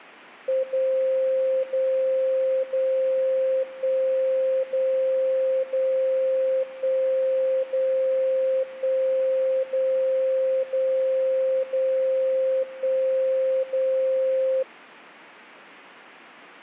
Radio time signal (DCF77), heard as a tone whose level steps once a second, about 530 Hz. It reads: 0 0 0 1 0 0 1 0 1 0 0 0 1 0